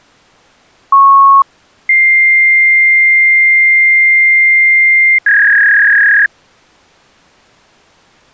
Fax machine handshake, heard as a beep, a long tone and a warble.